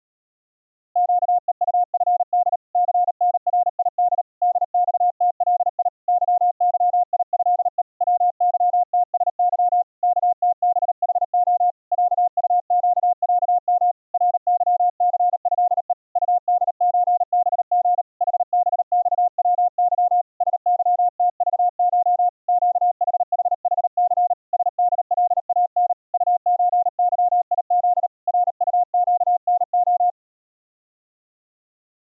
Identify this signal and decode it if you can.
Morse code (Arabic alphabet), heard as a keyed tone, hand-sent with a paddle, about 38 wpm, 710 Hz. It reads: قءطفد ثنريد دصتلي ظظيهء وظتسظ كتبحخ عطقعم رظثهء طدزبغ حبصوظ سظتضش قحححث سدلان طزظيذ رطقنخ